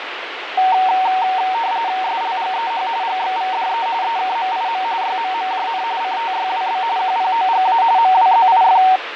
RTTY (45.45 baud, 170 Hz shift), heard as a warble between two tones, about 840 Hz centre, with radio static and fading. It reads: SLGEH GXVDE EKMIM YMMJN CTYWB QPOGA MWZIF